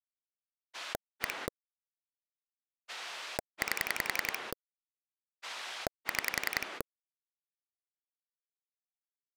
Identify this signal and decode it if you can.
Pulse dialling, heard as a rotary dial, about 10 pulses a second. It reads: 1 8 6